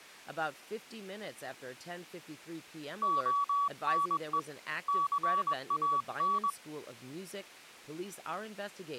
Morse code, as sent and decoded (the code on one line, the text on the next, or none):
--- -. . / -.-. .- -.
ONE CAN